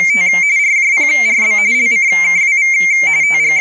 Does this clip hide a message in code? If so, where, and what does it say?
Yes: RTTY (45.45 baud, 170 Hz shift) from 0.0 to 3.6 s, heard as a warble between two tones, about 2200 Hz centre, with speech in Finnish. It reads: … RJPRB LCKWV …